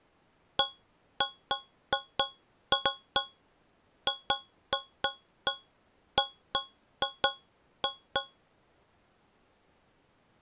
Irregular taps on a metal pipe. There is no code.